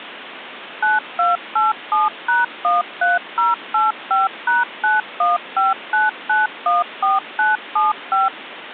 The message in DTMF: 9287#13085#9159914975

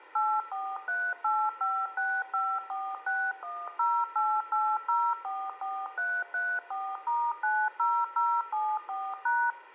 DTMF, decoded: 8438565461088044334*90074#

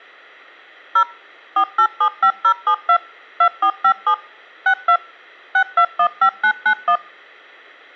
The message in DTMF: 0 4875072 2457 62 6215991

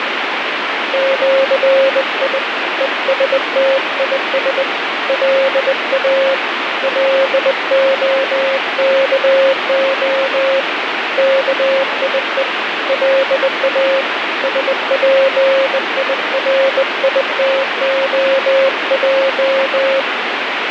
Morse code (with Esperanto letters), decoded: ĜI ESTIS LA LOKO KIE LA SPIRITOJ

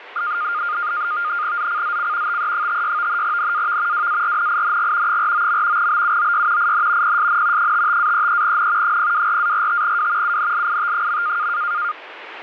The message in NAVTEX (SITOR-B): ZCZC TE56 NAV WARNING 49. BUOY IN PSN 55-33N 024-45W UNLIT.

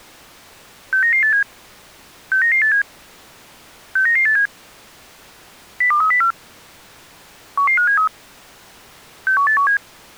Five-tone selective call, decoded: 69987 69987 69987 02304 11573 61817

